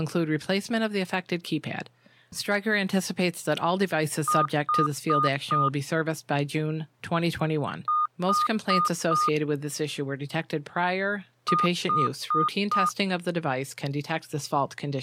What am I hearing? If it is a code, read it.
Beep code, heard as beeps, played three times, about 1220 Hz, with speech in English. 4 short. In AMI BIOS tables: system timer failure; in Dell tables: memory read or write failure.